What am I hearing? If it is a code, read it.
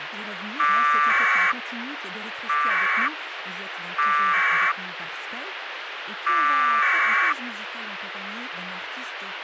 Packet radio (AX.25, as in APRS), 1200 baud, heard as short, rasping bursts, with radio hiss and speech in French.